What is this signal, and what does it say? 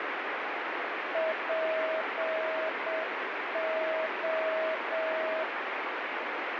Morse code (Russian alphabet), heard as a keyed tone, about 7 wpm, 640 Hz, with heavy radio static. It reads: ПО